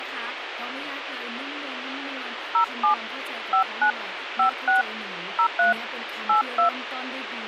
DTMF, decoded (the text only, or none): 07 59 56 03 82